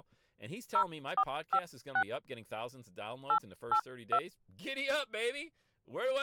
DTMF, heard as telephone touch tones, dialled by hand, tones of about 70 ms, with speech in English. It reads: 0456 882